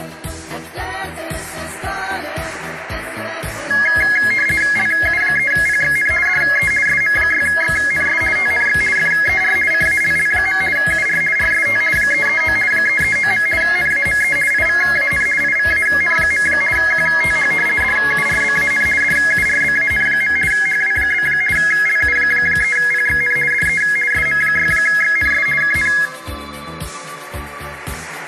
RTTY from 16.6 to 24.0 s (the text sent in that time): QTH DURBAN DURBAN. HW? LU3PXN DE